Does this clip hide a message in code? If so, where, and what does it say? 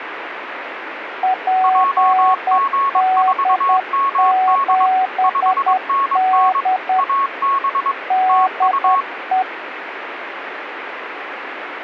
Yes: Morse code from 1.2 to 9.5 s, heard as two keyed tones, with radio static. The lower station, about 10 wpm, 750 Hz: PD7D DE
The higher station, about 22 wpm, 1100 Hz: JG4MD 5NN AB TU